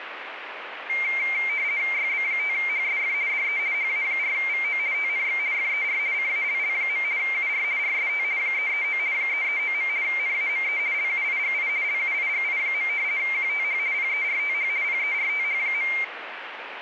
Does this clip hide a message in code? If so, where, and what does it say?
Yes: RTTY (50 baud, 170 Hz shift) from 0.9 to 16.0 s, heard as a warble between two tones, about 2200 Hz centre, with radio static. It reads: YB5HSF DE HA4VO TNX FER CALL. UR RST 339 339. NAME LUIGI LUIGI. QTH PERTH PERTH.